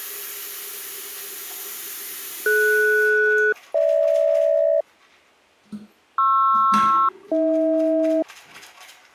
Aircraft SELCAL, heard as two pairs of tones, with the noise of a restroom. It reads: DS-GH PR-AH